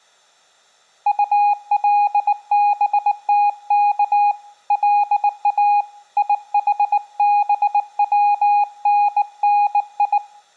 Morse code (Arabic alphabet), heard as a keyed tone, hand-sent with a bug key, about 19 wpm, 820 Hz. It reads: طلبتك لا يحبونني